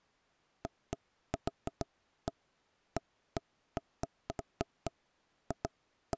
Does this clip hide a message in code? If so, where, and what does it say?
No, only irregular knocks on wood.